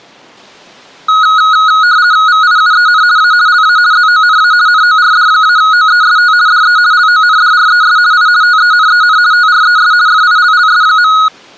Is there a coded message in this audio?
Yes: RTTY (50 baud, 170 Hz shift) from 1.1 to 11.3 s, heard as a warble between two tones, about 1360 Hz centre. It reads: VIUEN A LA ZONA NORD-OEST DE LONDRES I TENEN TRES FILLS.